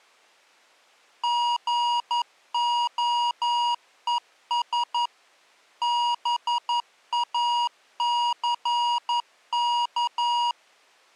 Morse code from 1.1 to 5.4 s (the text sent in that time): GOES